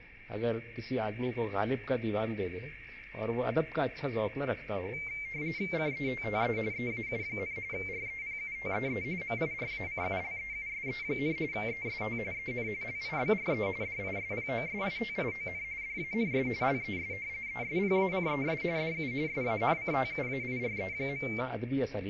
RTTY (45.45 baud, 170 Hz shift), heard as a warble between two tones, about 2200 Hz centre, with radio static and a narrow filter. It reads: CETTE EAU, REPUTEE MIRACULEUSE, EST EN LIBRE DISPOSITION DANS LES ESPACES DU SANCTUAIRE.